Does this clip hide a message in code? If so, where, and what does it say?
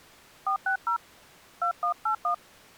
Yes: DTMF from 0.5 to 2.3 s, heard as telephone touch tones, dialled by hand, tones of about 100 ms. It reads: 460 2181